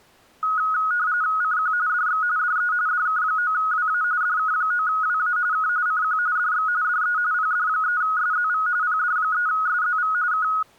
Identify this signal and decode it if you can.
RTTY (45.45 baud, 170 Hz shift), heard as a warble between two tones, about 1360 Hz centre. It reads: CQ DX DE DK9WA DK9WA K CQ DX DE PD3SZV PD3SZV K